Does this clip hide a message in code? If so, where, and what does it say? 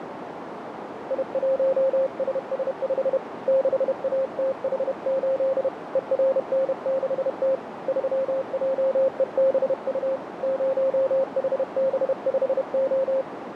Yes: Morse code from 1.0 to 13.3 s, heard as a keyed tone, hand-sent with a paddle, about 31 wpm, 530 Hz, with radio static and a narrow filter. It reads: I1SS5 6ATH8 ERN6T 3JEBU 0HB5O